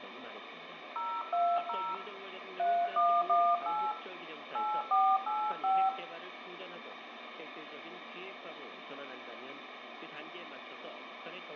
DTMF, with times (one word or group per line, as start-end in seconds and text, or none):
1.0-1.9 020
2.6-3.9 3118
4.5-5.9 8485